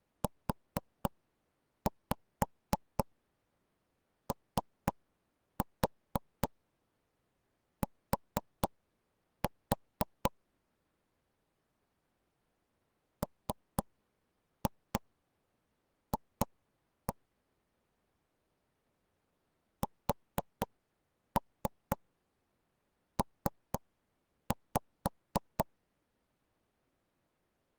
Tap code, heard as knocks on wood, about 4 knocks a second. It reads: UOT MF SP